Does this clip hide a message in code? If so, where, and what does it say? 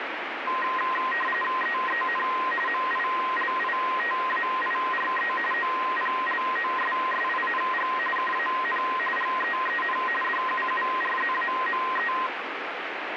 Yes: RTTY (45.45 baud, 850 Hz shift) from 0.5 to 12.3 s, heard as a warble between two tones, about 1460 Hz centre, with radio static. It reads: EEN MILITAIRE OPLOSSING KAN GEEN DUURZAME